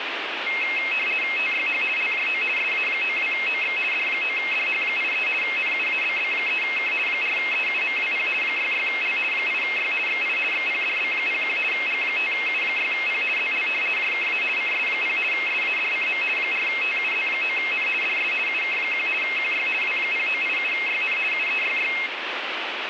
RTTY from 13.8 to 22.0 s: JKA CS0 SADCM 4TUZ9N DS UK1 QY W0987YN UEYY

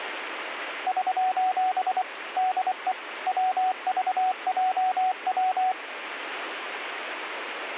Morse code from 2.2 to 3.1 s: DE

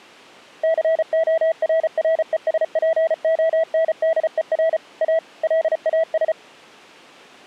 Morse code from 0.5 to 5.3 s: CORRESPONDER A

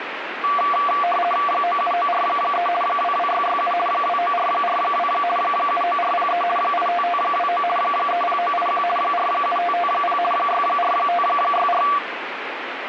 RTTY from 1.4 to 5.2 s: 97943 22667 29442

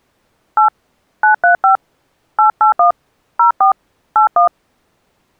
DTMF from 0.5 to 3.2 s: 8 935 881

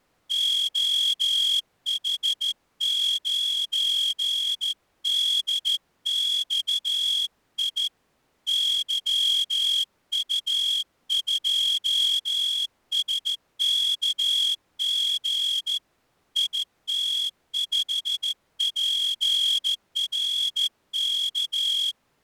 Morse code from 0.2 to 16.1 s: OH9DXI YU2SKG

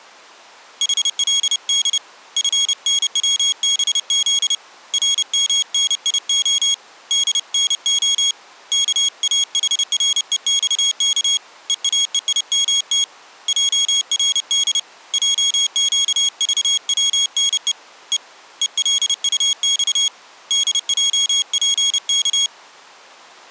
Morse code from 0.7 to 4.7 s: HLD FNWBZ

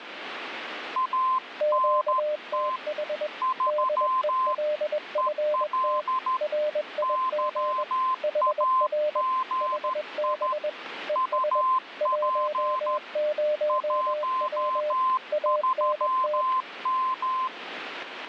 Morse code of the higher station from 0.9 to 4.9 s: ANT 3

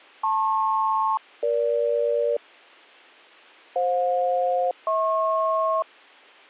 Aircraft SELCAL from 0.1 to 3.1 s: LP-EG

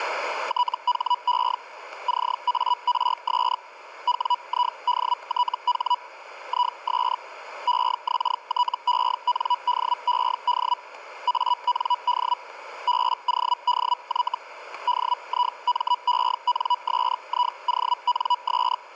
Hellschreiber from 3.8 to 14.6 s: WIDTH IS EXTENDED AND BODY

